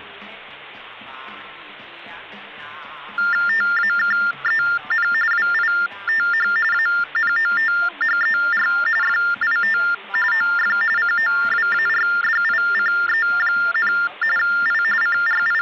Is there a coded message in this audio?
Yes: TTY/TDD text telephone tones (45.45 baud Baudot) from 3.2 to 15.6 s, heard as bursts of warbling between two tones, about 400 Hz shift, 1600 Hz centre. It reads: TAKEN WITH ANOTHER FIT OF COWARDICE, I …